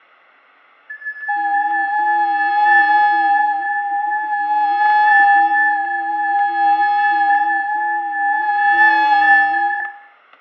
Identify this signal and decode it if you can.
FT8 (several signals at once), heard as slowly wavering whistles, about 6.25 baud, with fading, static crashes and room echo.